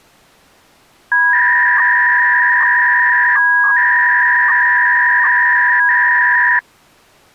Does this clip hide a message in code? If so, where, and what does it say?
Yes: 300-baud modem data (V.21 tones) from 1.1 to 6.6 s, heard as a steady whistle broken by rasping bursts, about 300 baud, 200 Hz shift.